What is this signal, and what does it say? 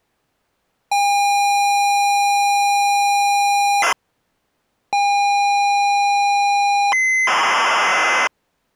ZX Spectrum tape loading, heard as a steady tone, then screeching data.